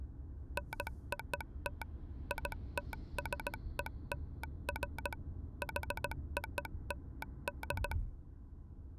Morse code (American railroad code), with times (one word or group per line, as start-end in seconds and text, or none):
0.6-1.8 NOT
2.3-5.1 ITSELF
5.6-7.9 HOLD